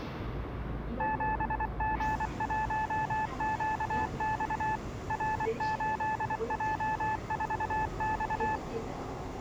Morse code, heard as a keyed tone, machine-sent, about 24 wpm, 870 Hz, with the noise inside a subway train. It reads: 7G1QX R8J4X